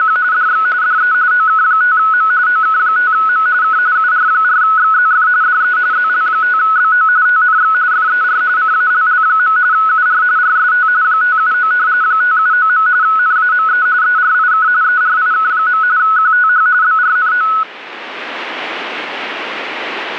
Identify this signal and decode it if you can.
RTTY (45.45 baud, 170 Hz shift), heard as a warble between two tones, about 1380 Hz centre. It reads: … DX DE OK5M OK5M K UR4XZF DE ZL5BO TNX FER CALL. UR RST 579 579. NAME ERIK ERIK. QTH BRNO